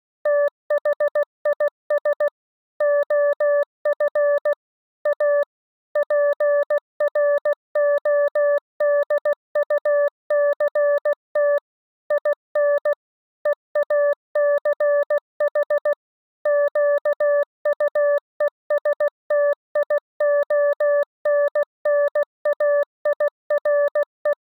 Morse code, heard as a keyed tone, machine-sent, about 16 wpm, 580 Hz. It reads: THIS OF A PRODUCT IN EACH QUESTIONNAIRE